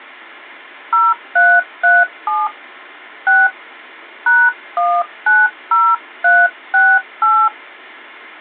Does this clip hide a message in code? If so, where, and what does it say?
Yes: DTMF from 0.9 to 7.5 s, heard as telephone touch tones, dialled by hand, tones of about 240 ms. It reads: 0337 6 #190368